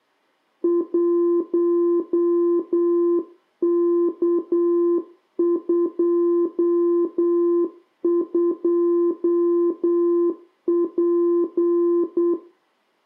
Morse code, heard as a keyed tone, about 8 wpm, 340 Hz, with room echo. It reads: 1K22P